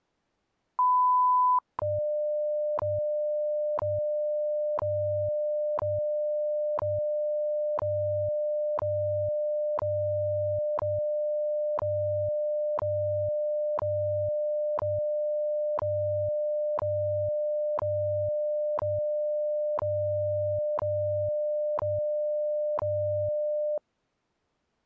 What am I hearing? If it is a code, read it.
Radio time signal (WWV, Colorado), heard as ticks, one a second.